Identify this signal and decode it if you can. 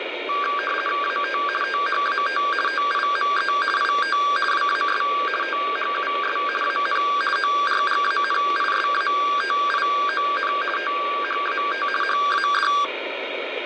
RTTY (50 baud, 450 Hz shift), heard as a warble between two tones, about 1380 Hz centre, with radio static. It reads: AT THAT TIME IT WAS THUS AN ORGANISATION THAT HAD